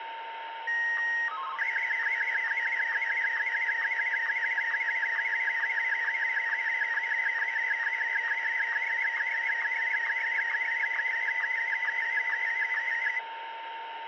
SSTV (slow-scan television), Martin M1, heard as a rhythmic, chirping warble, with radio static and a steady whistle near 910 Hz.